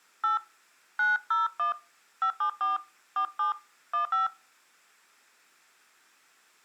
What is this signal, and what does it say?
DTMF, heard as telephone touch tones, dialled by hand, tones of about 130 ms. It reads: 8 901 574 47 15